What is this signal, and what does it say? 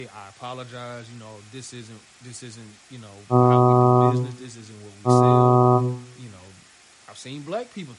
Ship horn signal, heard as a ship's horn, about 120 Hz, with room echo and speech in English. 2 short. At sea: I am altering course to port.